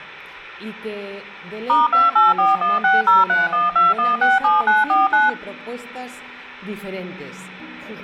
DTMF, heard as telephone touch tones, dialled by machine, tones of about 170 ms. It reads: *284160312167949